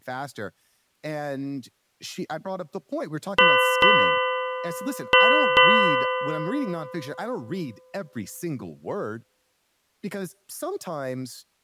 Ship's bell, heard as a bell, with speech in English. 4. Four half-hours of the watch have passed.